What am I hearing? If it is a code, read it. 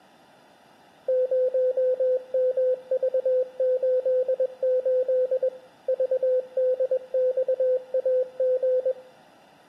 Morse code, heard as a keyed tone, machine-sent, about 21 wpm, 510 Hz. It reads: 0MV88 VDXAG